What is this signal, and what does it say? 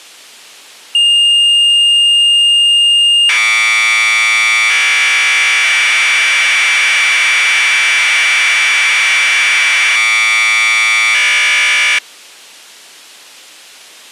Commodore tape loading (standard loader), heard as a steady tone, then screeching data.